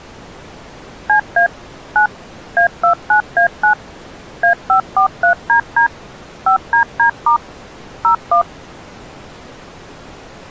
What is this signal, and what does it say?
DTMF, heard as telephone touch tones, dialled by machine, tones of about 100 ms. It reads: CA 9 A29A9 A543DD 5DD* 01